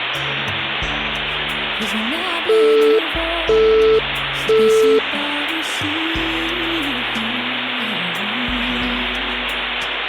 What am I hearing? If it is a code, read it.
Telephone call progress tone (single-tone plan, as in Europe, Japan and elsewhere), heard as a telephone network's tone, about 440 Hz, 0.5 s on and 0.5 s off, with phone line noise. Busy tone.